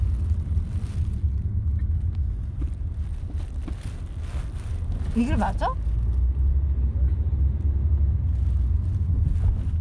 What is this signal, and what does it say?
The noise inside a car. There is no code.